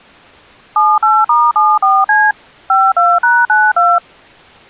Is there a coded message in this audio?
Yes: DTMF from 0.8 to 4.0 s, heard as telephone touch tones, dialled by machine, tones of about 220 ms. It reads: 78*74C 52#92